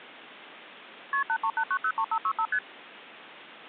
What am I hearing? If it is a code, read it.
Multi-frequency trunk signalling (R1, as on North American trunks), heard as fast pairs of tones, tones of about 70 ms. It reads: KP 838903565 ST